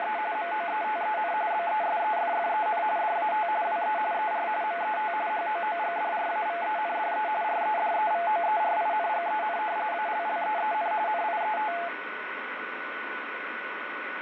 RTTY (45.45 baud, 170 Hz shift), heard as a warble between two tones, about 770 Hz centre, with radio static and a steady whistle near 1480 Hz. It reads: … MOETEN BESEFFEN DAT WE ER MET HOOGDRAVENDE REDEVOERINGEN ALLEEN NIET